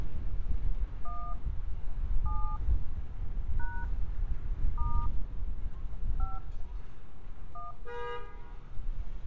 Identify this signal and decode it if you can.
DTMF, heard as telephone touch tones, dialled by hand, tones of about 230 ms, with room echo and street noise. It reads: 1 7 # * 5 1